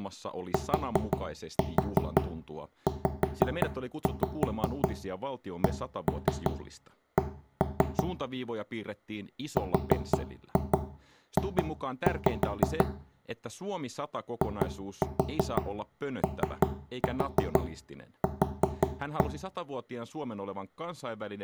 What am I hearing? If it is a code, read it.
Tap code, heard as knocks on wood, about 5 knocks a second, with room echo and speech in Finnish. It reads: TZCC RJ IOQ